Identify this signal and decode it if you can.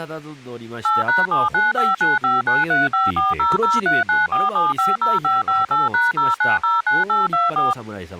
DTMF, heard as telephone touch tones, dialled by machine, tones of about 170 ms, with speech in Japanese. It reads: 8#79595935400394750558#0909824